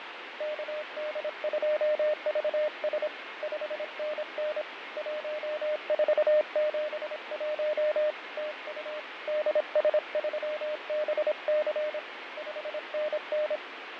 Morse code, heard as a keyed tone, hand-sent with a paddle, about 26 wpm, 610 Hz, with radio static and fading. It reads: KD2VS 5NN 1471 TU DS3BC 5NN